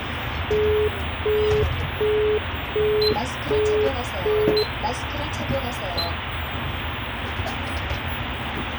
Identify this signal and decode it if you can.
Telephone call progress tone (as in the UK, Australia and similar networks), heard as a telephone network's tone, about 420 Hz, 0.375 s on and 0.375 s off, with phone line noise and the noise inside a bus. Busy tone.